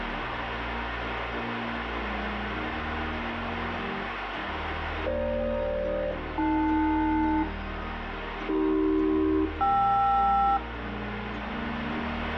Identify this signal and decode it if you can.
Aircraft SELCAL, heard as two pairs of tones, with radio static. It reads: FG-AL AC-KR